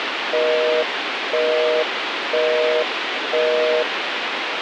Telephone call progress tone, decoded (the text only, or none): busy tone